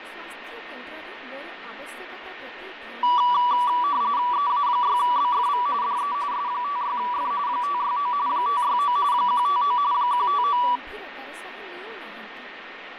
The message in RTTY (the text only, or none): EA6BFV DE S56F 569 569 159 159